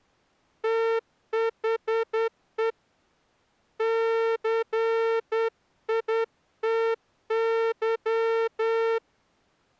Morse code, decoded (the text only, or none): THE CITY